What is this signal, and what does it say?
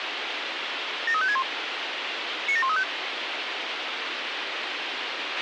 Five-tone selective call (ZVEI), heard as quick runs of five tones, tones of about 70 ms, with radio hiss and a squelch burst at the end. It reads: 73561 97135